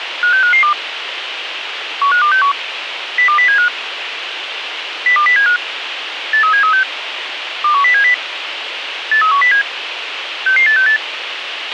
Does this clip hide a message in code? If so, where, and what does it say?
Yes: five-tone selective call (CCIR) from 0.2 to 11.0 s, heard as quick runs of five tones, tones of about 100 ms, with radio hiss and a squelch burst at the end. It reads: 56552 15261 02075 02075 83736 21070 83107 66868